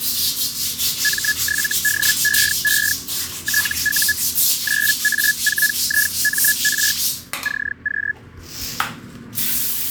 Hellschreiber (Feld-Hell, 122.5 baud), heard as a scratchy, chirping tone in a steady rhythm, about 1700 Hz, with the noise of a restroom. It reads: M7DEE TU 9A4IMR CQ